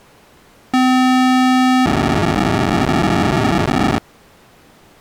POCSAG pager data (512 baud), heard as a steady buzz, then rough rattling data.